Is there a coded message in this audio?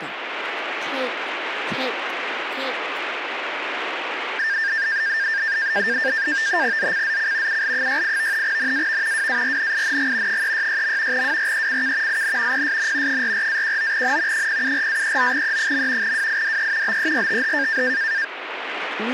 Yes: NAVTEX (SITOR-B), 100 baud, 170 Hz shift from 4.4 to 18.2 s, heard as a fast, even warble, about 1700 Hz centre, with radio static. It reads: ZCZC UL68 NAV WARNING 366. WRECK IN PSN 44-19N 074-39E. WIDE BERTH